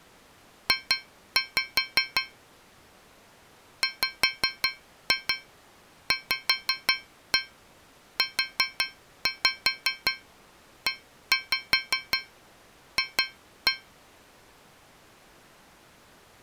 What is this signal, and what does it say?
Tap code, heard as taps on a metal pipe, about 5 knocks a second. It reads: J WVUEF